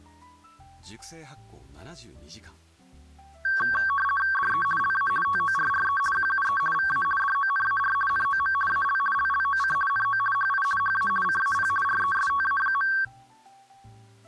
RTTY (50 baud, 450 Hz shift), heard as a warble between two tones, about 1340 Hz centre. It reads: DE LA TORRE QUE VA DONAR NOM AL LLOC NO HI HA CAP RESTA.